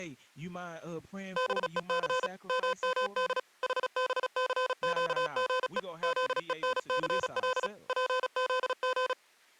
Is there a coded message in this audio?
Yes: Morse code (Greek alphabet) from 1.3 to 9.2 s, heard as electronic beeps, machine-sent, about 36 wpm, 510 Hz, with speech in English. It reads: ΒΕΘ ΜΜΔ ΗΒΘΨΓΕ ΖΕΝΘΛ ΠΖΓ